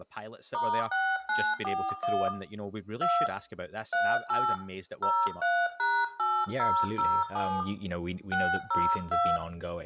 DTMF, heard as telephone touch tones, dialled by hand, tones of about 250 ms, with room echo and speech in English. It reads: *6941 2 38 03#8007 602